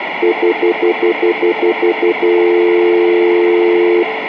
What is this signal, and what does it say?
Telephone call progress tone (North American plan), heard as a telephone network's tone, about 350, 440 Hz, 0.1 s on and 0.1 s off, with phone line noise. Stutter dial tone.